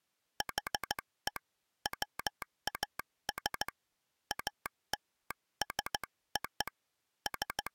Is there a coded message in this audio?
Yes: Morse code (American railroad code) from 0.3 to 7.7 s, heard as a telegraph sounder, hand-sent with a straight key. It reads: HE WAS ALSO …